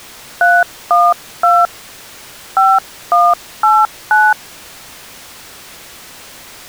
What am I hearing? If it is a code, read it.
DTMF, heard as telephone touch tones, dialled by hand, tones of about 220 ms. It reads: 312 5189